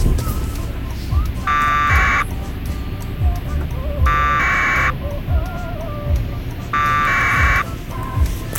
Packet radio (AX.25, as in APRS), 1200 baud, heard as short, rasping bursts, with a squelch burst at the end and the noise inside a car.